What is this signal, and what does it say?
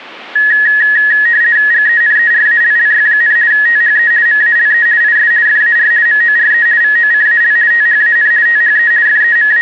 RTTY (50 baud, 170 Hz shift), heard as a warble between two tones, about 1800 Hz centre. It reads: GENERALLY, THE MALE IS FAR MORE VOCAL THAN THE …